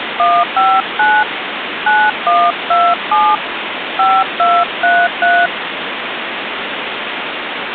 DTMF, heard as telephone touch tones, dialled by hand, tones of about 240 ms, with phone line noise. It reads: 159 9127 5233